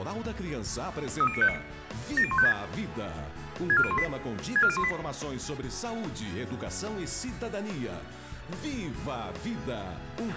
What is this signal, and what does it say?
Five-tone selective call (ZVEI), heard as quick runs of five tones, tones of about 70 ms, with a squelch burst at the end. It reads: 30959 70156 64018 64018